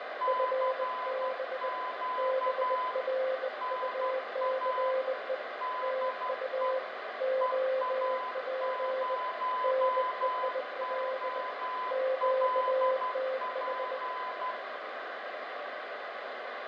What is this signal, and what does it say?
Morse code, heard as two keyed tones, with radio static and room echo. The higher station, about 12 wpm, 1010 Hz: CQ NA DE EA0OLP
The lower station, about 20 wpm, 520 Hz: FB BRUCE TU OP NEIL QTH